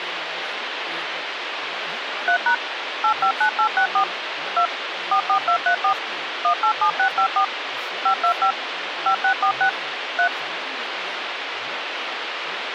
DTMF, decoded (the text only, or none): 3# 859864 2 44234 187654 525 5646 3